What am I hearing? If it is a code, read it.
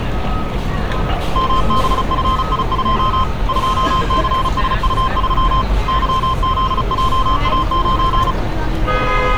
Morse code, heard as a keyed tone, hand-sent with a paddle, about 35 wpm, 1040 Hz, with street noise. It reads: MBFI2 2CSU3 YZJA9